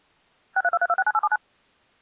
DTMF, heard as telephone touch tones, dialled by machine, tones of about 40 ms. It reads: 6323269879